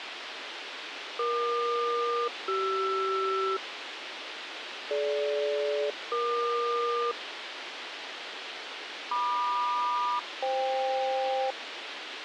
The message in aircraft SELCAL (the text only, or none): EQ-CR DG-EQ MQ-FK